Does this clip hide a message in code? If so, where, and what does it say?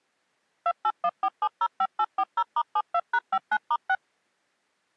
Yes: DTMF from 0.7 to 4.0 s, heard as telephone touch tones, dialled by machine, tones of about 60 ms. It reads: 2814705840*72#59*6